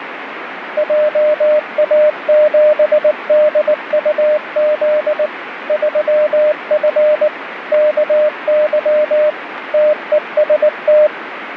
Morse code, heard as a keyed tone, machine-sent, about 19 wpm, 600 Hz, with radio static. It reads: JA7DUZ 3F KY TEST